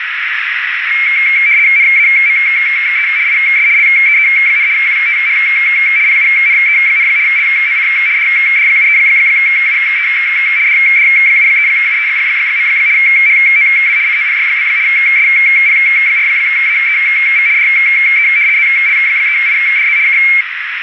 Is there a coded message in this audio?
Yes: RTTY (75 baud, 170 Hz shift) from 0.9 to 20.4 s, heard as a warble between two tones, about 2250 Hz centre, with radio static and a narrow filter. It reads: NAME IS LEE, QTH PUNE, LOC DD73UE DD73UE. HOW COPY? SP4AEV DE ZL3IDZ K